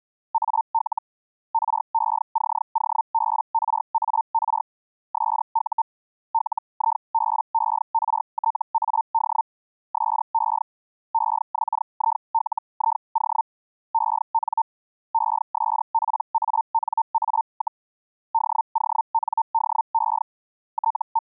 Hellschreiber (Feld-Hell, 122.5 baud), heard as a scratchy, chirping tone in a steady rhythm, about 900 Hz. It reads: AL RECOBRAR SU LIBERTAD SE EXILIO EN ESPANA, DONDE …